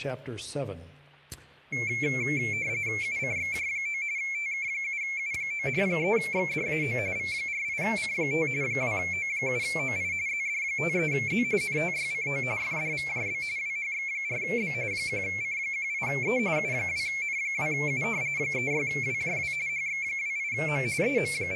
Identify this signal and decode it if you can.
RTTY (45.45 baud, 170 Hz shift), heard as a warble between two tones, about 2250 Hz centre. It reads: UCXJ9 TK7U9 3XDAO V48C5 2O7OI ZD53Z NTYCO FDVJB WHX4B 1C18E U2N2U 36WJW HX28M …